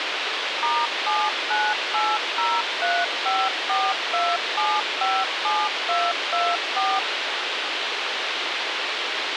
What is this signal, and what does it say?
DTMF, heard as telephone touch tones, dialled by machine, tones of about 230 ms, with radio hiss. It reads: *79803542757224